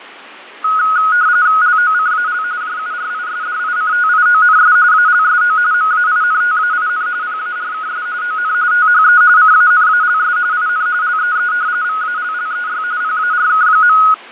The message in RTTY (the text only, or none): LOCAL JURISDICTIONS ALSO MAINTAIN PARKS ON THE CANALS IN LEE VALLEY PARK.